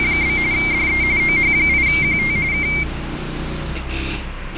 RTTY (45.45 baud, 170 Hz shift), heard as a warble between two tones, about 2200 Hz centre, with radio static and street noise. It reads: … DE OH8QT K